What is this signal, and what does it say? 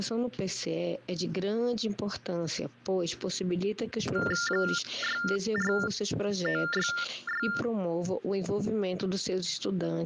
TTY/TDD text telephone tones (45.45 baud Baudot), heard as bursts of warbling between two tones, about 400 Hz shift, 1600 Hz centre, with hum. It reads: 64966